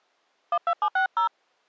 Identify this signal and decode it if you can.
DTMF, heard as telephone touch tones, dialled by hand, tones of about 100 ms. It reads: 12760